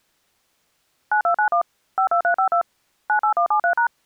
DTMF, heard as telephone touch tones, dialled by machine, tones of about 100 ms. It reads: 9291 52352 98173#